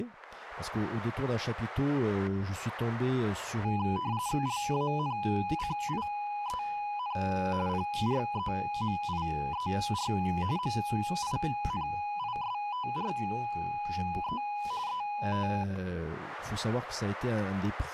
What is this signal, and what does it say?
RTTY (45.45 baud, 170 Hz shift), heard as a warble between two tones, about 910 Hz centre, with static crashes and speech in French. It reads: LANCIEN PREMIER MINISTRE ET